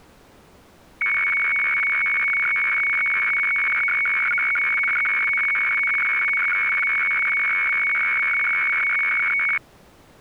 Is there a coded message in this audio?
Yes: weather fax (radiofax), 120 lines a minute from 1.0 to 9.6 s, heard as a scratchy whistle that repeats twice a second.